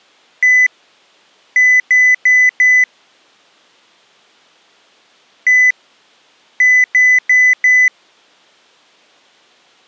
Beep code, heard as beeps, played twice, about 2000 Hz. 1-4.